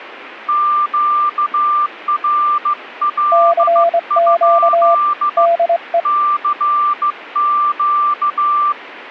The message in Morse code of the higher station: QRL? CQ

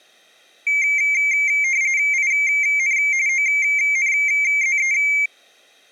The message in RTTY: IN ONZE

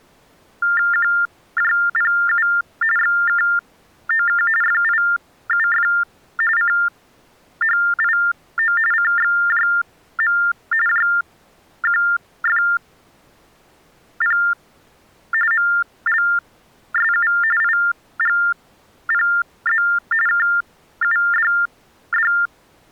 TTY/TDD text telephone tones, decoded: QJPU XKOK FIUF CHIO CXJM JQFP MLSU IGPZ KUDD

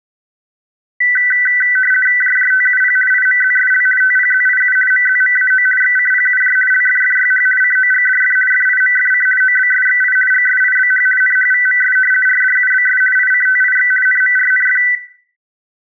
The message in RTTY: JJTUP IMZSL TPZIU MZMAO XCPUJ LFFYH COGDF FIMFC OBSXI GSIBH NHVMS RDUBS ICTIX NMRNF

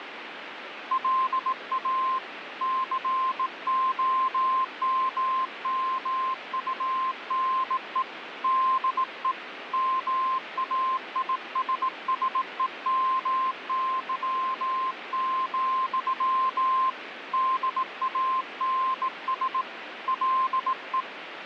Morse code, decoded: LA COMMUNE DE MAISSEMY, DANS LE

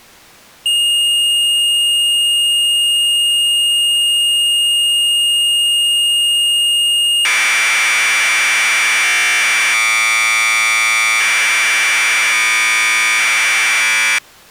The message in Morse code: none

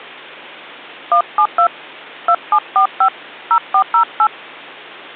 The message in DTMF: 172 2745 0408

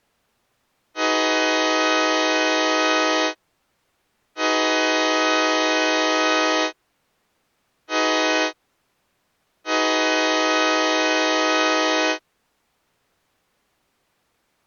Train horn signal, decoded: 2 long, 1 short, 1 long

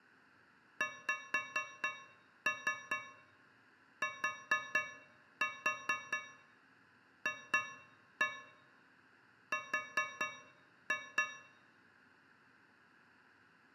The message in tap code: XTFR

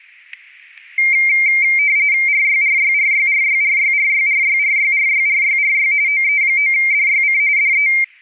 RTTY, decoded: RYRYRYRYRYRYRYRYRYRYRY OE9DYC DE

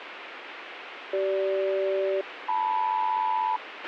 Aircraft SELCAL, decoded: CG-LM

